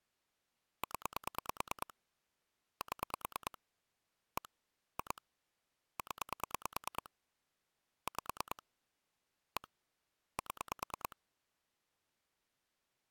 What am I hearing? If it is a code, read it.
Pulse dialling, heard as clicks on a phone line, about 9 pulses a second. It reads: 0 7 1 2 0 5 1 7